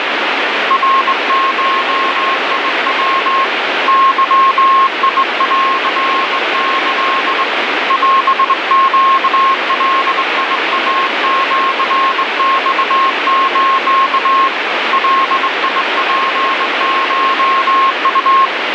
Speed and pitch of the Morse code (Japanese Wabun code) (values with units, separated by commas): 21 wpm, 1080 Hz